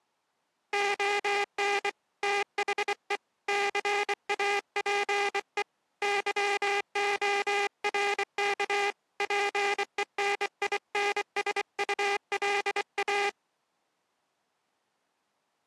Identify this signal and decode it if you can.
Morse code, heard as a buzzer, hand-sent with a bug key, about 24 wpm. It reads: ON THE CAPE YORK PENINSULA